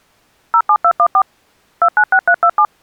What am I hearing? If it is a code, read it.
DTMF, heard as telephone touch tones, dialled by machine, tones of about 70 ms. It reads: 07214 296327